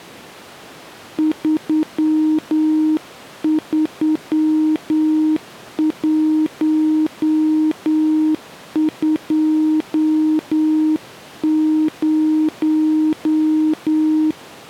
Morse code, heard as a keyed tone, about 9 wpm, 310 Hz. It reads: 33120